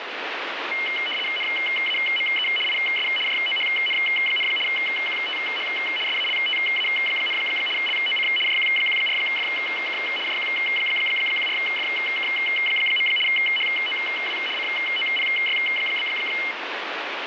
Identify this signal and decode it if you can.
RTTY (75 baud, 850 Hz shift), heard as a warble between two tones, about 2550 Hz centre, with radio static. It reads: NAME IS JOHN, QTH SALTA, LOC JQ14FK JQ14FK. HOW COPY?